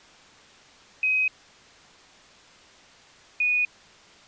Quindar tones, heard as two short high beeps.